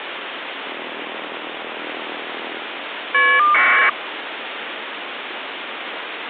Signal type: caller ID data burst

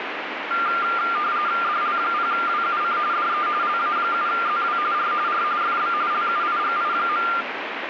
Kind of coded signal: RTTY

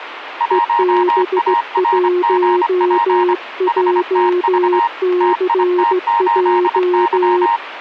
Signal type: Morse code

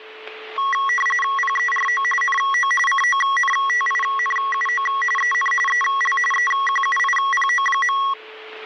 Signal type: RTTY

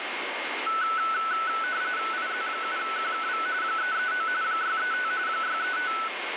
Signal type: RTTY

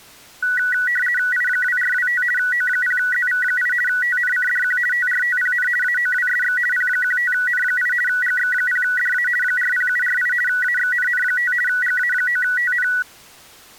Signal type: RTTY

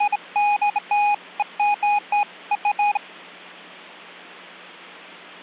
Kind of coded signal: none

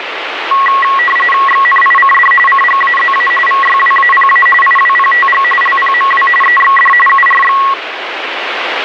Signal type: RTTY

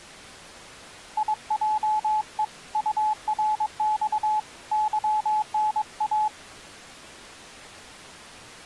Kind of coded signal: Morse code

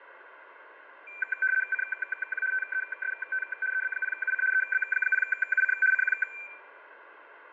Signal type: RTTY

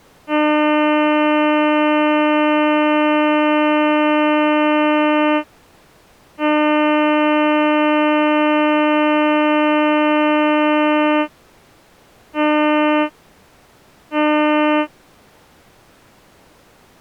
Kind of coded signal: ship horn signal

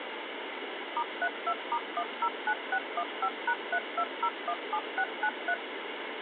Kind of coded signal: DTMF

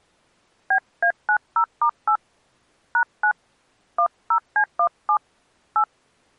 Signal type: DTMF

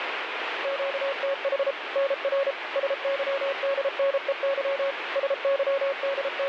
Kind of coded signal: Morse code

